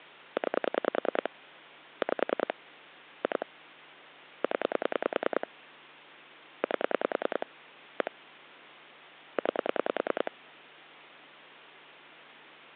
Pulse dialling, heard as clicks on a phone line, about 10 pulses a second, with phone line noise. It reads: 9 5 2 0 8 1 9